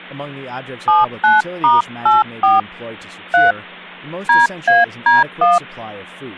DTMF, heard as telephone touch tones, dialled by hand, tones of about 170 ms, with speech in English. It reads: 79*84 3 DAD1